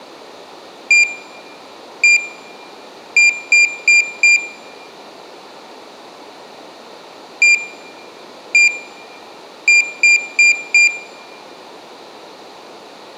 Beep code, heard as a piezo beeper, played twice, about 2400 Hz, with room echo. 1-1-4. In Phoenix BIOS tables: BIOS ROM checksum failure.